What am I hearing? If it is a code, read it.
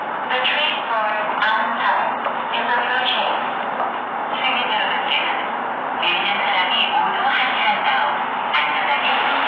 The noise of a subway station. There is no code.